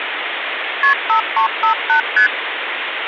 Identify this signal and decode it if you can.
Multi-frequency trunk signalling (R1, as on North American trunks), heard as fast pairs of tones, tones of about 100 ms, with phone line noise. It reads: KP 5358 ST